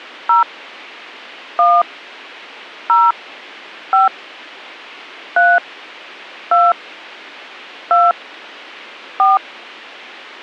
DTMF, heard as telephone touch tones, dialled by hand, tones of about 190 ms. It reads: 0 1 0 5 3 2 2 4